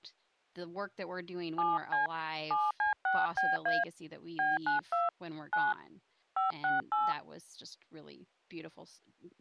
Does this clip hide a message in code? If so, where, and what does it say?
Yes: DTMF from 1.6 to 7.1 s, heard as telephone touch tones, dialled by hand, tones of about 170 ms, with speech in English. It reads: 7C 7C6BA B92 9 568